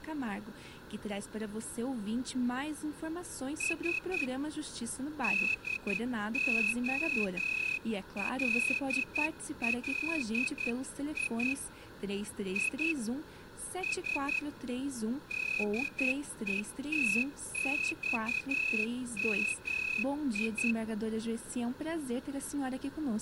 Morse code (Russian alphabet), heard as a whistle, hand-sent with a straight key, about 10 wpm. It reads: С ДОЛЛИ И С ДЕТЬМИ